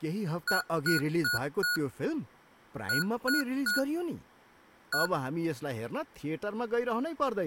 Beep code, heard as beeps from a small speaker, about 1450 Hz, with speech in Nepali. 4-3-1. In Phoenix BIOS tables: memory failure above the first 64 KB.